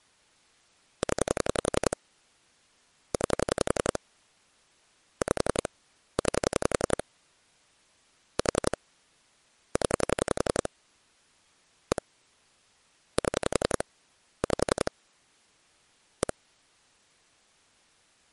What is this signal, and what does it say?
Pulse dialling, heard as clicks on a phone line, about 11 pulses a second. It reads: 0 9 5 9 4 0 1 7 5 1